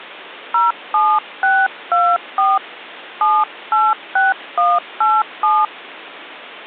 DTMF, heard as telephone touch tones, dialled by hand, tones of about 200 ms. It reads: 07624 786187